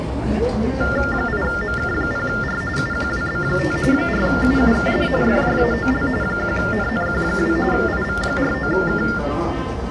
TTY/TDD text telephone tones (45.45 baud Baudot), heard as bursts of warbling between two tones, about 400 Hz shift, 1600 Hz centre, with the noise of a subway station. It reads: 8MK0R UQWB5 4UUKD FJAOL 1NNQ2 IV49K